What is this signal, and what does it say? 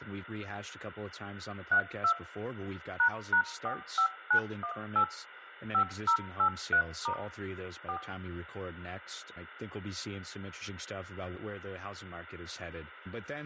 DTMF, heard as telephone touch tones, dialled by machine, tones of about 90 ms, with room echo and speech in English. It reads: 32 ##45918 5083* 4